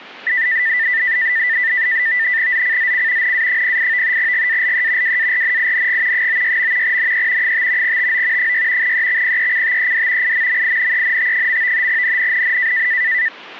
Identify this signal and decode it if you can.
NAVTEX (SITOR-B), 100 baud, 170 Hz shift, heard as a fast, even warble, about 1900 Hz centre. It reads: ZCZC NA08 GALE WARNING 96. NE 5 TO 6 EXPECTED IMMINENT. NNNN